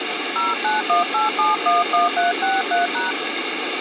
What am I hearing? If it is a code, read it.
DTMF, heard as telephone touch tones, dialled by hand, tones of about 160 ms, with phone line noise. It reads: 0918711363#